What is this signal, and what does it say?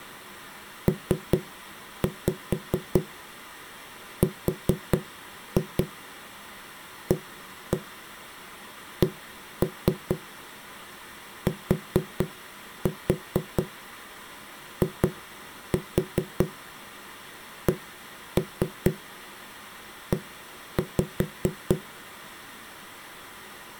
Tap code, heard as knocks on a wall, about 4 knocks a second. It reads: PRACTICE